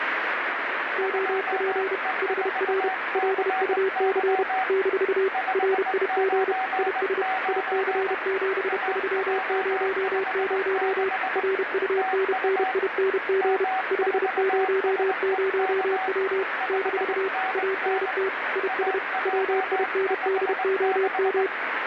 Morse code, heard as two keyed tones, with radio static. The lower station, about 31 wpm, 380 Hz: OP HR LUC - RIG IS IC7300 RUNNING 500W - ANT IS WINDOM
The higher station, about 20 wpm, 760 Hz: 2E4CY 599 AJ56 TU M4SEK 5NN AJ56